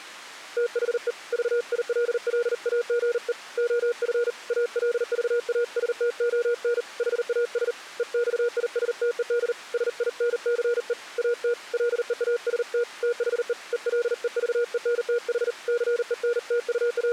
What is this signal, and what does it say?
Morse code, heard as a keyed tone, hand-sent with a paddle, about 39 wpm, 480 Hz. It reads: THE VILLAGE OF ALVASTON HAS EXISTED SINCE AT LEAST THE ELEVENTH …